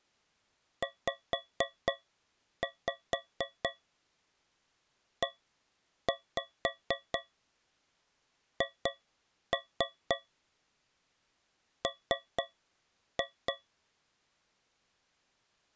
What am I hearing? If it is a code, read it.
Tap code, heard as taps on a metal pipe, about 4 knocks a second. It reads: ZEHM